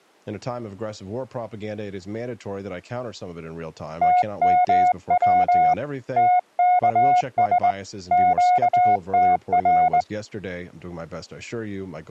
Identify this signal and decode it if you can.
Morse code, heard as a keyed tone, hand-sent with a straight key, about 20 wpm, 720 Hz, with speech in English. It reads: TMW TKS QTR